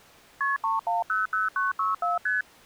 Multi-frequency trunk signalling (R1, as on North American trunks), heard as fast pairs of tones, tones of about 160 ms. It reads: KP 3100964 ST